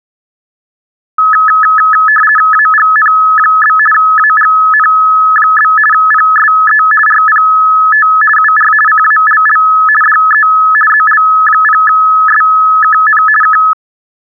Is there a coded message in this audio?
Yes: RTTY (50 baud, 450 Hz shift) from 1.2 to 13.7 s, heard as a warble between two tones, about 1500 Hz centre. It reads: AGN? AGN? PSE RPT UR CALL DE ZL0SKN K